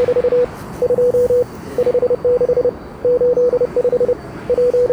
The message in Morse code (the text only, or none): … 2 56 85 …